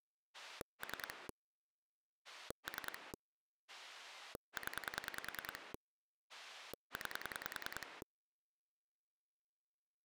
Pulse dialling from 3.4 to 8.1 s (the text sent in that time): 0 9